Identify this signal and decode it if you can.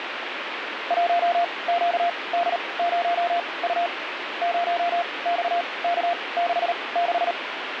Morse code, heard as a keyed tone, machine-sent, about 38 wpm, spaced as for 24 wpm, 690 Hz, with radio static. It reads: 1QD0U 0XK66